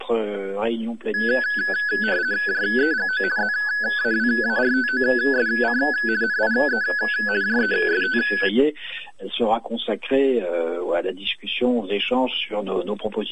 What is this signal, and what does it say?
RTTY (50 baud, 170 Hz shift), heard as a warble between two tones, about 1600 Hz centre. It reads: JEGO ZAWARTOSC NIE JEST